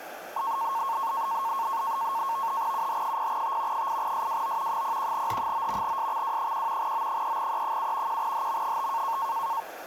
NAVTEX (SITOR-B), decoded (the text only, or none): UH0T 8SWO 01H9 SXW1 O3E7 1HM5